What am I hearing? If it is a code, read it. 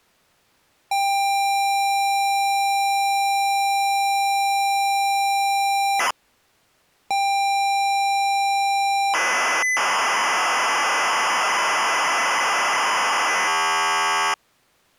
ZX Spectrum tape loading, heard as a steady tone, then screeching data.